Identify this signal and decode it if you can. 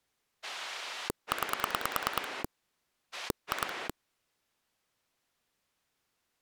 Pulse dialling, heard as a rotary dial, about 9 pulses a second. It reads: 9 2